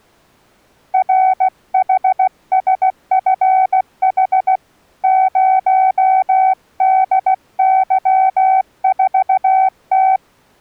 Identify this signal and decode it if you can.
Morse code, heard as a keyed tone, hand-sent with a paddle, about 16 wpm, 760 Hz. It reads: RHSFH 0DY4T